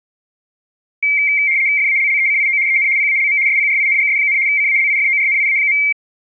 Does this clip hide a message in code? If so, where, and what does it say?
Yes: RTTY (75 baud, 170 Hz shift) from 1.0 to 5.9 s, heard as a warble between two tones, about 2200 Hz centre. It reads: FALLECIO EN PALM SPRINGS, CALIFORNIA.